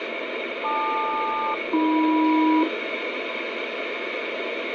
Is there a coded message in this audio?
Yes: aircraft SELCAL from 0.6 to 2.6 s, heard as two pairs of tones, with radio static. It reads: LQ-AM